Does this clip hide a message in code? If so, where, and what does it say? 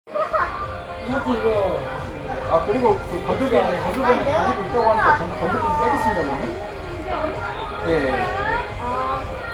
No, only the noise of a crowd indoors.